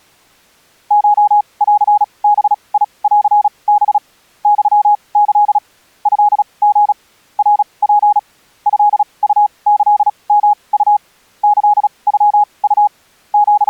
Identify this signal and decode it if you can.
Morse code (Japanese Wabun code), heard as a keyed tone, machine-sent, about 36 wpm, spaced as for 26 wpm, 830 Hz. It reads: コンバンハ ユキ トリ ナツ トウキヨウ キノウ …